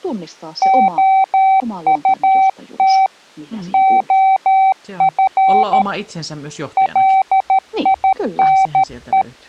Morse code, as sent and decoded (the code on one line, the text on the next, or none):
--- ..- - / --- ..-. / .-.. .. -. .
OUT OF LINE